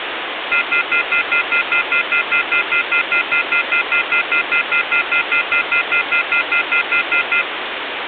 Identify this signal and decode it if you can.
Telephone call progress tone (North American plan), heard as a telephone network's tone, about 1400, 2050, 2450, 2600 Hz, 0.1 s on and 0.1 s off, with phone line noise. Off-hook warning tone.